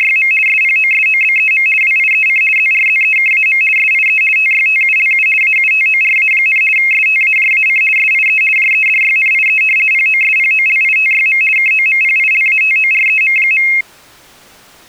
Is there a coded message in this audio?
Yes: RTTY (50 baud, 450 Hz shift) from 0.0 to 13.8 s, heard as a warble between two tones, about 2350 Hz centre. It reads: … SPOSOBEM WIEC ZRZEKAM SIE TYTULU AUTORA, STAJAC SIE JEDYNIE POSPOLITYM KOMPILATOREM.